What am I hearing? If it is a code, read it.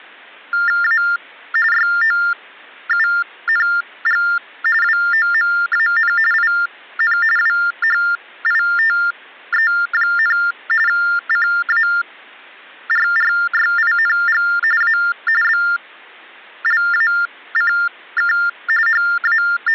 TTY/TDD text telephone tones (45.45 baud Baudot), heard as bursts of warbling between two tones, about 400 Hz shift, 1600 Hz centre. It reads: A YOUNG WOMAN IN WHITE, CARRYING A BLACK …